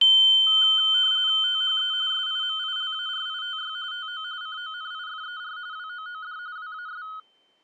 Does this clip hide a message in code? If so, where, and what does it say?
Yes: RTTY (45.45 baud, 170 Hz shift) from 0.5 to 7.2 s, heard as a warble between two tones, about 1360 Hz centre. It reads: THE SIMILARITY TO CONIFER WOOD WAS